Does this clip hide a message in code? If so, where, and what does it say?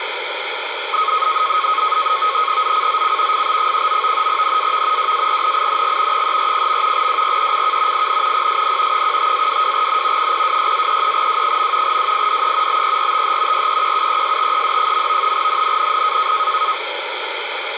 Yes: NAVTEX (SITOR-B), 100 baud, 170 Hz shift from 0.9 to 16.7 s, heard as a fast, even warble, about 1180 Hz centre, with radio static. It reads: ZCZC FB19 NAV WARNING 340. WRECK IN PSN 15-22N 026-33W. WIDE BERTH REQUESTED. NNNN